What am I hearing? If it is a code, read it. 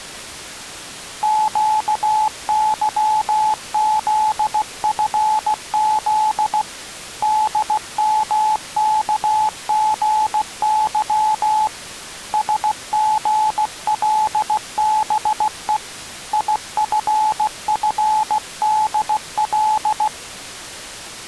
Morse code, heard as a keyed tone, hand-sent with a paddle, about 16 wpm, 860 Hz. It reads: QYZFZ DMKGY SGLBE IFFDL